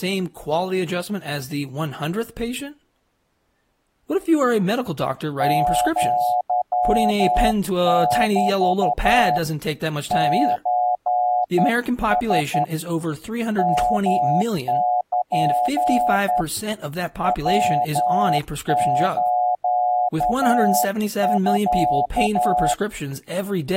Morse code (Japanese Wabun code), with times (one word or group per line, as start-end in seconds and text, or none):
5.4-9.4 アメ
10.1-12.6 ソラ
13.6-16.4 ヨル
17.2-22.7 ヤスミ